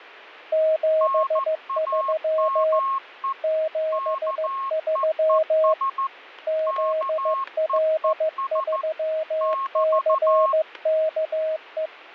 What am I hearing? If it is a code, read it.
Morse code, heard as two keyed tones, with static crashes. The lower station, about 15 wpm, 630 Hz: 73 73 ZL3CKE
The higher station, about 14 wpm, 1080 Hz: NAME KEES KEES <BT>